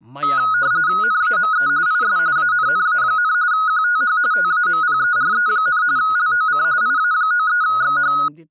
RTTY (45.45 baud, 170 Hz shift), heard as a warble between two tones, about 1360 Hz centre, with speech in Sanskrit. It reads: NAME IS ANNA, QTH TAMPERE, LOC IA93XH